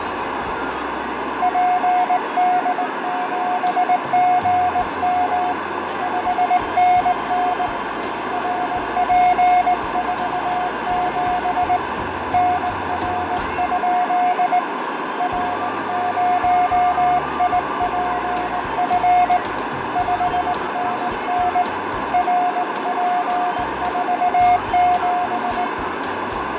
Morse code, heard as a keyed tone, hand-sent with a straight key, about 19 wpm, 720 Hz, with heavy radio static, fading and a narrow filter. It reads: PD7GM 5NN RP47 NR? R0IPF 5NN RP47